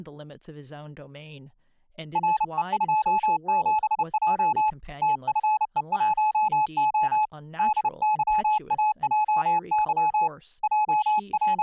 Morse code, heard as a keyed tone, hand-sent with a paddle, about 30 wpm, 860 Hz, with speech in English. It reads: RE27J TFE1O DYAJY …